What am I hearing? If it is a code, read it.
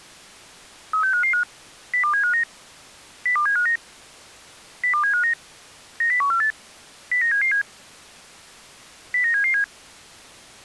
Five-tone selective call (CCIR), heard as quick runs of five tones, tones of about 100 ms. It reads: 36555 02759 02759 02759 90148 09777 09777